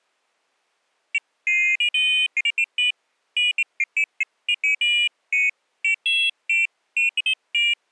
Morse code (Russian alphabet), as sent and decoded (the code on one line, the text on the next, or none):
none